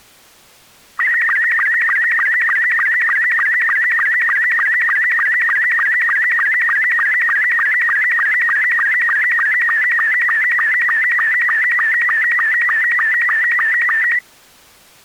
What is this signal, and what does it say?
SSTV (slow-scan television), Robot 72, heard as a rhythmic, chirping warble.